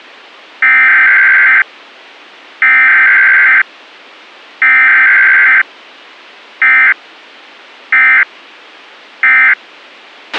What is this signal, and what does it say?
Emergency Alert System (SAME) tones (header bursts, then end-of-message bursts), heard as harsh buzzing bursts, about 520.83 baud, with a squelch burst at the end.